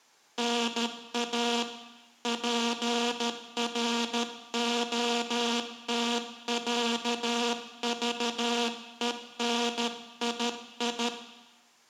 Morse code (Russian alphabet), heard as a buzzer, hand-sent with a paddle, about 13 wpm, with room echo. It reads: НА ПРОТЯЖЕНИИ